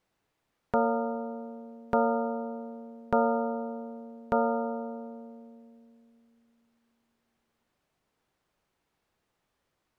Clock strike, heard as a bell. 4. Four o'clock.